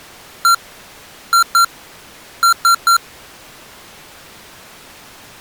Beep code, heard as beeps from a small speaker, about 1370 Hz. 1-2-3. In Phoenix BIOS tables: DMA page register failure.